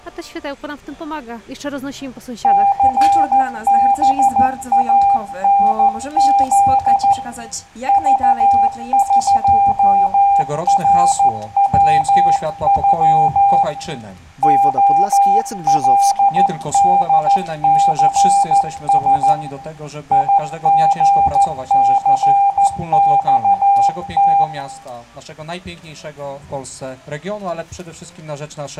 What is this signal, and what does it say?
Morse code (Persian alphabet), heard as a keyed tone, hand-sent with a paddle, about 14 wpm, 800 Hz, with room echo. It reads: ثبانز ذقروغ علدثس یژثخت